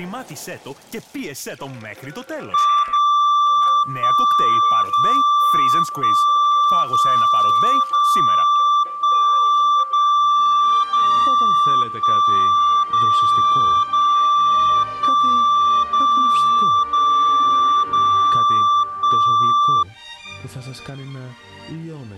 Radio time signal (DCF77), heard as a tone whose level steps once a second, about 1170 Hz. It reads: 0 1 0 1 0 0 1 0 0 1 0 0 1 0 0 0 1